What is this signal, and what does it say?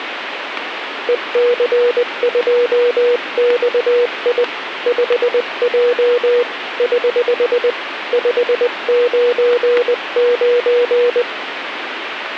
Morse code, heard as a keyed tone, hand-sent with a paddle, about 20 wpm, 480 Hz, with radio static. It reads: EC2XI 5J <HH> 599